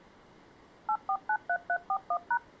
DTMF, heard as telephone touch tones, dialled by machine, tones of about 70 ms. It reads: 8493341#